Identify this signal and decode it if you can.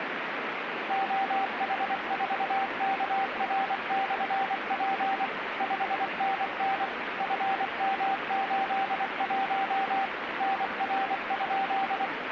Morse code, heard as a keyed tone, machine-sent, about 24 wpm, 780 Hz, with radio static. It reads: OH4KR/P 5NN FM81 NR?